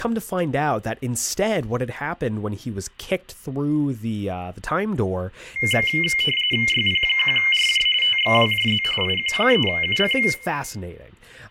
RTTY (45.45 baud, 850 Hz shift), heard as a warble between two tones, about 2550 Hz centre, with room echo and speech in English. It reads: YP1RJ TXWJZ IQ3UC